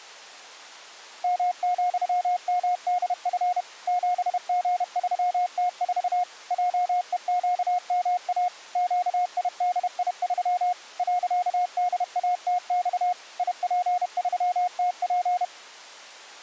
Morse code, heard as a keyed tone, machine-sent, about 31 wpm, 720 Hz. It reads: M,MDF 7G3T4 JEQMA QIDI3 .DATX IP3TP